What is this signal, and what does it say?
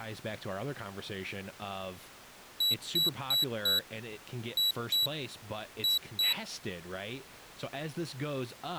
Beep code, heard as a piezo beeper, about 3900 Hz, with speech in English. 4-2-2. In Phoenix BIOS tables: shutdown test failure.